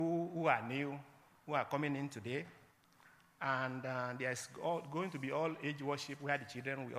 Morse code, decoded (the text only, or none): none